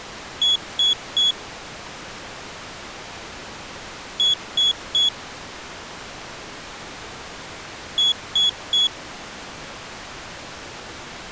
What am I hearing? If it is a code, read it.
Beep code, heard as a piezo beeper, played three times, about 3350 Hz. 3 short. In AMI BIOS tables: failure in the first 64 KB of memory; in Dell tables: chipset error.